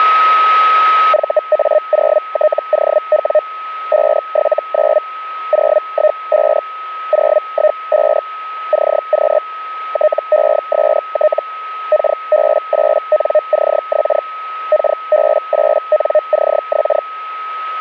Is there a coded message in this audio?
Yes: Hellschreiber (Feld-Hell, 122.5 baud) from 1.1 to 17.0 s, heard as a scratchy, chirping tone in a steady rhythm, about 610 Hz, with a steady whistle near 1280 Hz. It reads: VA0TOW 579 015 015 CQ TEST KB8NCX KB8NCX